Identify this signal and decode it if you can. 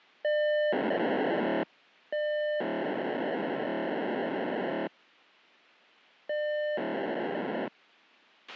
POCSAG pager data (1200 baud), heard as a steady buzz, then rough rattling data, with a squelch burst at the end.